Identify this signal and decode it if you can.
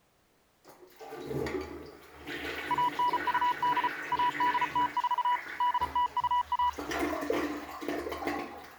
Morse code (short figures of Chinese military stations), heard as a keyed tone, machine-sent, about 34 wpm, 980 Hz, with the noise of a restroom. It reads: 1928 1804 8021